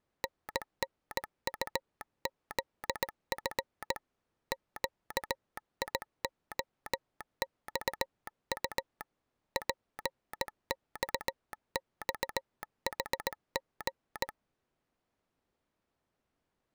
Morse code, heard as a telegraph sounder, hand-sent with a straight key, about 18 wpm. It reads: NNUZF QIOXU PXXHG